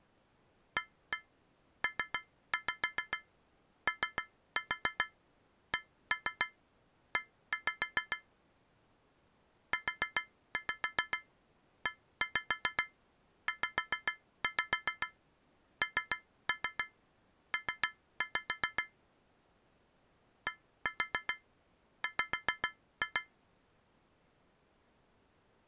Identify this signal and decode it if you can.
Tap code, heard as taps on a metal pipe, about 7 knocks a second. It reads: APOCE UEZNP DW